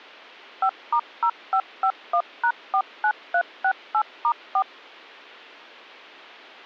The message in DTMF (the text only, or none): 5*0551#49368*4